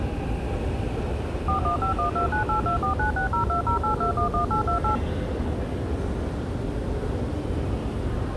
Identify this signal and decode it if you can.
DTMF, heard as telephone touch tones, dialled by machine, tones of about 110 ms, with the noise of a subway station. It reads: 415129824960208211828